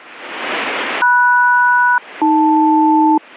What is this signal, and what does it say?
Aircraft SELCAL, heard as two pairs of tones. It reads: MS-AL